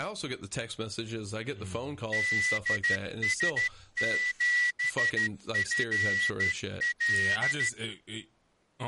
Morse code, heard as a whistle, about 13 wpm, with speech in English. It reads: DS7FL